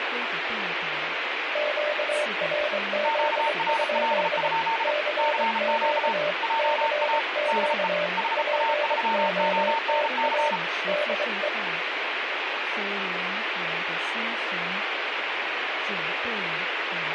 Morse code, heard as two keyed tones, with radio static. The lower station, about 23 wpm, 600 Hz: QRZ? CQ CQ POTA DE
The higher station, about 34 wpm, 910 Hz: QRL? CQ JA DE HA3ONC